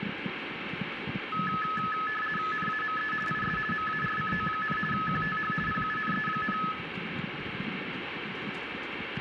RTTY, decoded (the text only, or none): NAME IS MARCO, QTH PUNE,